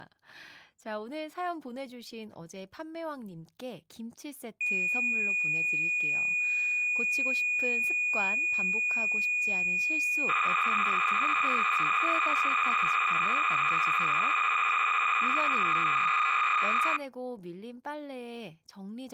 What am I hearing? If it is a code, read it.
Cassette data (Kansas City type), 300 baud, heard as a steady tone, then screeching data, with speech in Korean.